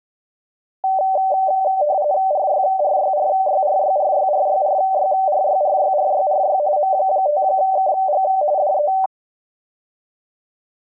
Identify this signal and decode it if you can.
RTTY (45.45 baud, 170 Hz shift), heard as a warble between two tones, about 680 Hz centre. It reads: RYRYRYRYRYRYRYRYRYRYRY M5KG DE